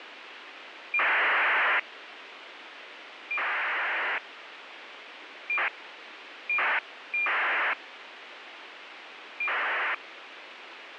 ACARS aircraft data, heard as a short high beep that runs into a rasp, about 2400 baud, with radio hiss.